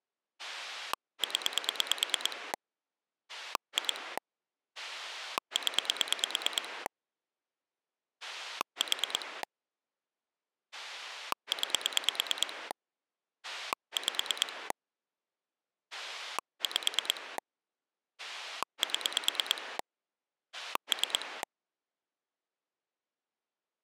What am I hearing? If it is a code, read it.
Pulse dialling, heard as a rotary dial, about 9 pulses a second. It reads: 0 2 0 4 9 5 5 7 3